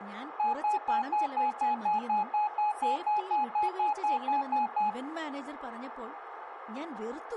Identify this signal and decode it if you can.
Evenly repeated beeps, with radio static, room echo and speech in Malayalam. There is no code.